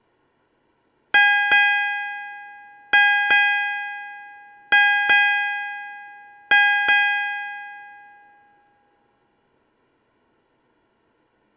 Ship's bell, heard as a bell. 8. Eight half-hours of the watch have passed.